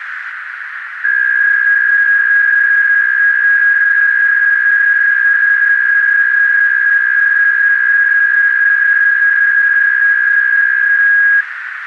PSK63 (62.5 baud), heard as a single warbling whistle, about 1650 Hz, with radio static and a narrow filter.